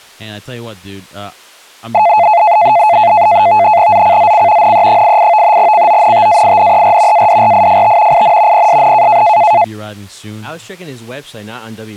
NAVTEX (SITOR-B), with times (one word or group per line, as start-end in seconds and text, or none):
3.9-4.7 ZCZC
4.6-5.6 NE88
5.6-7.3 CONTAINER
7.1-8.2 ADRIFT
8.1-8.7 IN
8.5-9.2 PSN